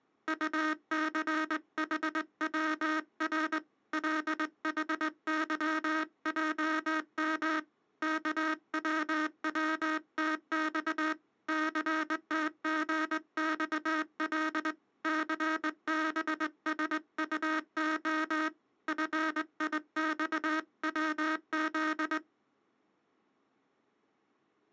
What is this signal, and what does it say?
Morse code, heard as a buzzer, hand-sent with a straight key, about 20 wpm. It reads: UCHWR LHYJM KWWTX CTGXL CBSUO FIXWZ